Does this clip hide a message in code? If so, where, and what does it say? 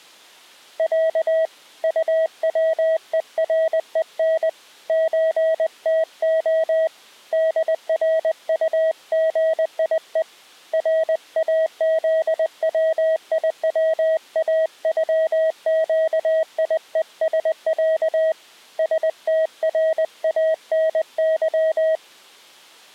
Yes: Morse code (Russian alphabet) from 0.7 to 22.0 s, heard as a keyed tone, hand-sent with a paddle, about 20 wpm, 640 Hz. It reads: Я УВЕРЕН ЧТО ДРУГИЕ РАЗВИВАЮЩИЕСЯ СТРАНЫ